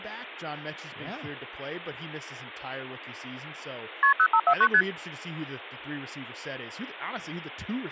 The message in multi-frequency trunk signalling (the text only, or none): KP 0549 ST